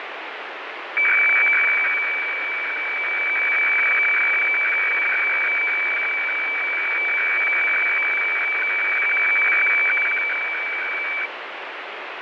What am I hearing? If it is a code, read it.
Weather fax (radiofax), 120 lines a minute, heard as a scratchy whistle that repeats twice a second, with radio static and fading.